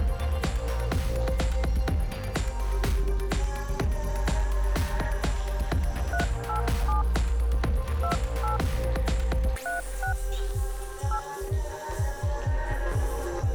DTMF, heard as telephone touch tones, dialled by hand, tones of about 110 ms. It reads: 387 28 36 8